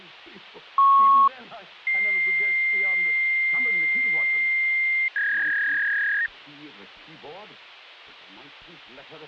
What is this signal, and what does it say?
Fax machine handshake, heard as a beep, a long tone and a warble, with phone line noise.